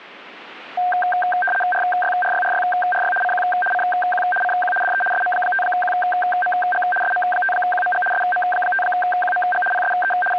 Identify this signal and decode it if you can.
RTTY (75 baud, 850 Hz shift), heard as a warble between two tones, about 1150 Hz centre. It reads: RYRYRYRY CQ CQ CQ DE SM5QMG SM5QMG SM5QMG PSE …